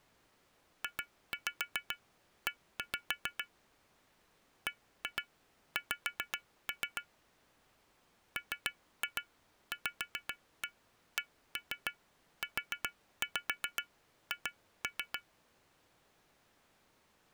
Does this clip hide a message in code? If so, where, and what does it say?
Yes: tap code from 0.8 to 15.3 s, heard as taps on glass, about 7 knocks a second. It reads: JE BX MVCUH